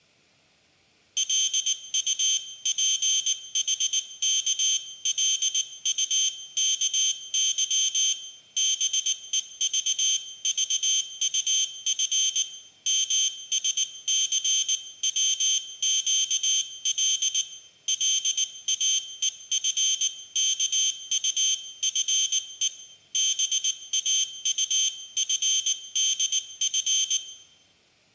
Morse code (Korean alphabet), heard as a high beeper, hand-sent with a paddle, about 19 wpm, 3150 Hz, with room echo. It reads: 기중기에 달린 몇백 관이나 되는